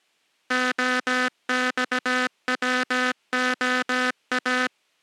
Morse code (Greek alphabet), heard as a buzzer, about 17 wpm. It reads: ΟΞΩΟΑ